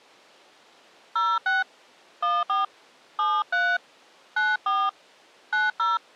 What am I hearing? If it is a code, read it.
DTMF, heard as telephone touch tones, dialled by hand, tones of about 220 ms. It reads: 06 14 73 94 90